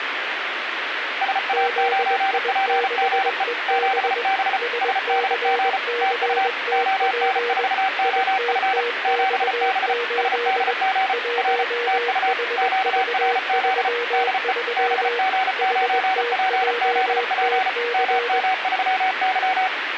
Morse code, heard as two keyed tones, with radio static. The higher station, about 34 wpm, 760 Hz: SA9PGE 7B SDG TU ON4OF 7B SDG R TU QRZ DE BG9PZP MM3Y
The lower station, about 21 wpm, 480 Hz: ZI6EB SCCTP ITTX8 1HV33 HTJTC